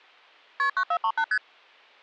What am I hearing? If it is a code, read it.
Multi-frequency trunk signalling (R1, as on North American trunks), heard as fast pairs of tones, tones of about 70 ms. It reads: KP 9438 ST